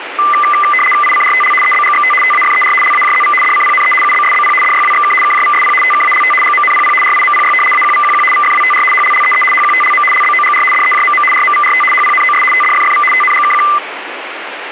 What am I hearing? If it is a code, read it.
RTTY (75 baud, 850 Hz shift), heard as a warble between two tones, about 1600 Hz centre, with radio static. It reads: ICRTL EBGXT TAFER LAJZV DCPNE UBSBP DYWXK KJVSP TKALT GMNPP RIMPY AQVQQ VFWTR HLLEE HQTLM LBOGR DEJMM RMVRT HPNOS TDFFV TNGKQ